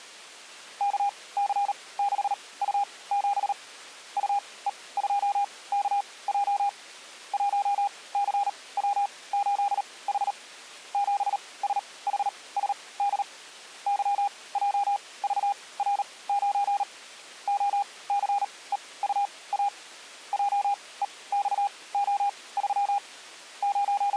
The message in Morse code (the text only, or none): KC6U7 UE2KJ 1CW8H 7SHSD YJVR9 OCEUA JEXO3 …